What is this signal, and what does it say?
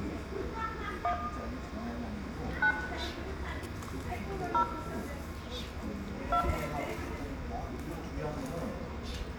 DTMF, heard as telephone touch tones, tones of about 80 ms, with room echo and the noise of a residential street. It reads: 1 9 0 2